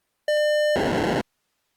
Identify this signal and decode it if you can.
POCSAG pager data (1200 baud), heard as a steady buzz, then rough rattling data.